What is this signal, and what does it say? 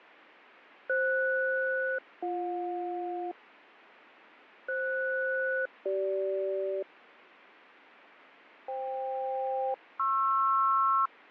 Aircraft SELCAL, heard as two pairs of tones, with radio static and fading. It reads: FS-BJ FS-CG FK-PR